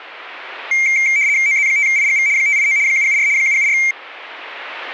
RTTY (75 baud, 170 Hz shift), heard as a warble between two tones, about 2200 Hz centre. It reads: OZ5IGV 589 774 774